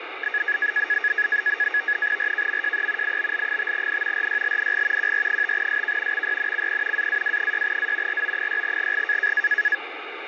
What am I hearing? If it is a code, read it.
NAVTEX (SITOR-B), 100 baud, 170 Hz shift, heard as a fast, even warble, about 1750 Hz centre, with radio static. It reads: RKMJE IBL5N RYLNG QR5SK XYNCP AAW6A RO6GG